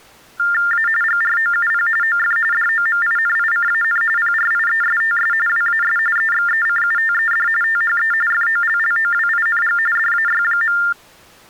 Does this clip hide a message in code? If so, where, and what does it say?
Yes: TTY/TDD text telephone tones (45.45 baud Baudot) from 0.4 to 10.9 s, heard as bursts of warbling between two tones, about 400 Hz shift, 1600 Hz centre. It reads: A GROUP OF DOMINICAN PRIESTS WAS EXECUTED THE FOLLOWING DAY.